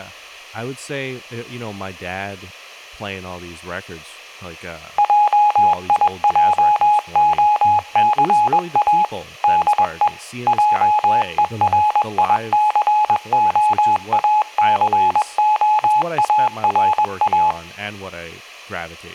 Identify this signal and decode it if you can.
Morse code, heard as a keyed tone, machine-sent, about 21 wpm, 840 Hz, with speech in English. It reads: JIJOCA DE JERICOACOARA